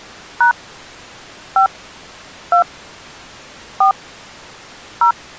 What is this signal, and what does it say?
DTMF, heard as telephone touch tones, dialled by hand, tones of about 100 ms. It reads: # 5 2 4 0